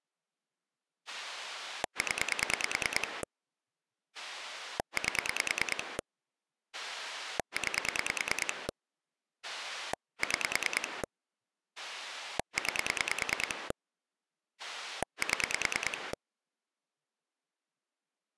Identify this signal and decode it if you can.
Pulse dialling, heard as a rotary dial, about 9 pulses a second. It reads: 0 8 9 6 9 7